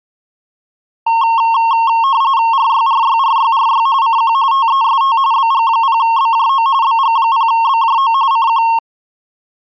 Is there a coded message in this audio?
Yes: RTTY (45.45 baud, 170 Hz shift) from 1.1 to 8.8 s, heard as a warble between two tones, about 1000 Hz centre. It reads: RYRYRYRY CQ TEST BG0BJO BG0BJO CQ